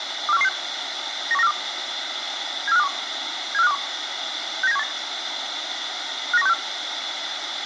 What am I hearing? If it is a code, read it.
Five-tone selective call (EEA), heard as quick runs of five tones, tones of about 40 ms, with radio hiss. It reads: 24116 91942 74521 74521 69718 59164